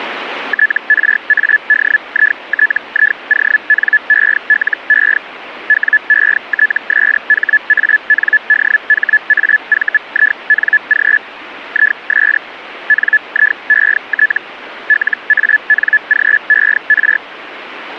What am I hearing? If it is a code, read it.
Hellschreiber (Feld-Hell, 122.5 baud), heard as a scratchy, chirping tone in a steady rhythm, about 1700 Hz. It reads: TRADITIONELE WETSHANDHAVING IS NIET LANGER